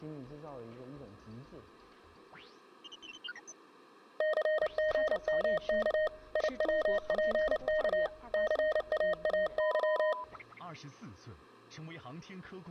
Morse code, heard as a keyed tone, machine-sent, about 29 wpm, 620 Hz. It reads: CGMK IWPK CAAY